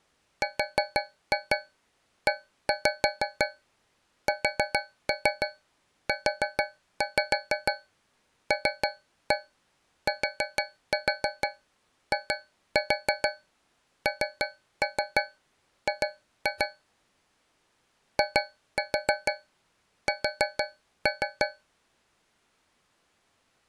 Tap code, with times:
0.4-16.7 RESULTING
18.2-21.5 IS

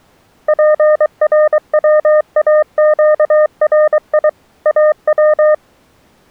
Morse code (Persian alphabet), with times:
0.5-4.3 پرواگری
4.7-5.5 او

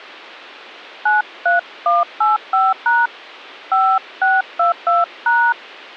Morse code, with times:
none

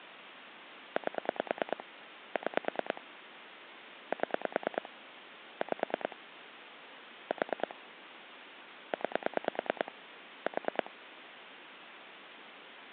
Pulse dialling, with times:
1.0-1.8 8
2.4-3.0 6
4.1-4.9 7
5.6-6.2 5
7.3-7.7 4
8.9-9.9 9
10.5-10.9 4

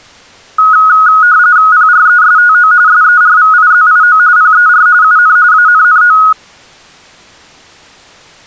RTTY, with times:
1.7-2.7 PRESTO
2.9-4.2 SERVIZIO
4.4-4.9 PER
5.0-5.4 UN
5.5-6.2 ANNO

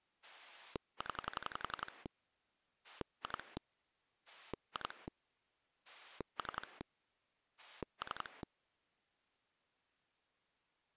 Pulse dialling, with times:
0.2-2.1 0
2.8-3.6 2
4.3-5.1 2
5.8-6.8 3
7.6-8.4 3

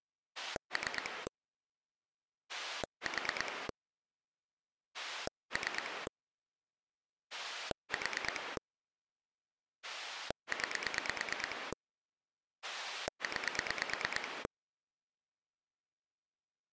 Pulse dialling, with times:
0.4-1.3 3
2.5-3.7 4
4.9-6.1 3
7.3-8.6 4
9.8-11.7 9
12.6-14.5 9

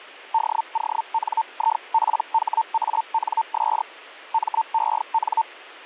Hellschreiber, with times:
0.3-3.8 DONIPHANS
4.3-5.4 MEN

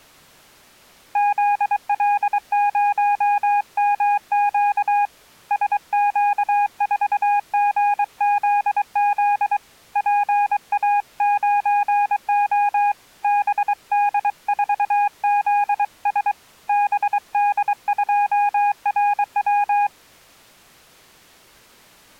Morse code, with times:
1.2-5.1 ZL0MQ
5.5-9.6 SQ4GZZ
10.0-12.9 PA9O
13.2-16.3 BD4ZS
16.7-19.9 BD2RW

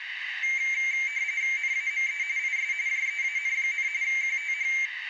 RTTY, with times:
1.6-2.2 NAME
2.4-2.7 IS
2.9-3.9 JEAN,
4.0-4.7 QTH

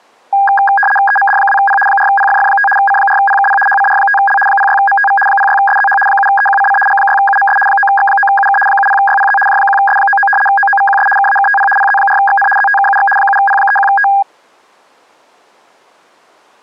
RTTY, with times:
1.1-1.8 EMD2P
1.9-2.7 4PFF5
2.8-3.6 C4PKP
3.7-4.4 HCR5L
4.5-5.2 06MTV
5.3-6.0 06SZH
6.1-6.8 7EQCC
6.9-7.6 G6UMS
7.7-8.6 9X9UK
8.7-9.4 70YPZ
9.5-10.3 J1S99
10.5-11.1 OOVQS
11.2-11.7 KAKTP
11.8-12.5 PZ4XN
12.6-13.1 ZTKUX
13.2-14.1 7P31T

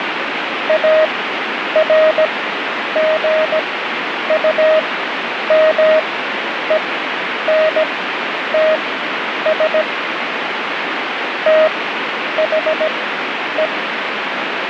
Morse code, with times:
0.7-9.8 ARGUMENTS
11.5-13.7 THE

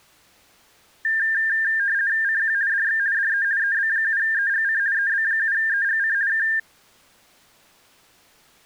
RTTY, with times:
2.2-2.5 CQ
2.7-3.0 DX
3.1-3.4 DE
3.6-4.8 EB7EGC
4.9-6.1 EB7EGC
6.3-6.4 K

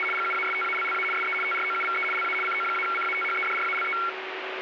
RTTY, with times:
0.0-0.0 …
0.1-1.0 GUASTALLA
1.1-1.3 SE
1.4-2.0 TROUVE
2.1-2.3 LA
2.4-3.9 CO-CATHEDRALE

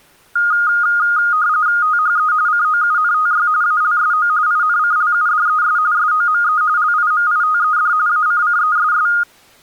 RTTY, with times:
1.8-2.3 THE
2.5-3.5 COUNTY
3.6-4.3 ALSO
4.5-5.8 INCLUDES
5.9-6.6 SOME
6.8-7.9 LIMITED
8.1-9.1 ACCESS

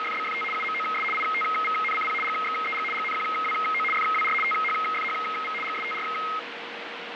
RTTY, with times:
0.0-0.4 …
0.5-1.0 UMOS
1.1-2.1 ITVNCP
2.2-2.8 GXEG
2.9-3.8 GNQWO
3.9-4.3 FWR
4.4-5.5 THFHV
5.6-6.0 GSTR

